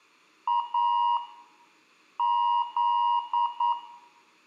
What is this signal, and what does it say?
Morse code, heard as a keyed tone, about 9 wpm, 960 Hz, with room echo. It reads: A Z